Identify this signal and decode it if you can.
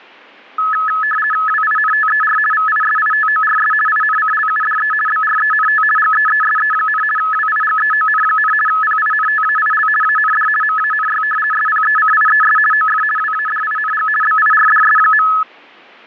RTTY (50 baud, 450 Hz shift), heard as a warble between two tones, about 1500 Hz centre. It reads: WINTER VISITORS INCLUDE BRENT GEESE, WIGEON, PINTAIL AND MANY SPECIES OF WADING BIRDS.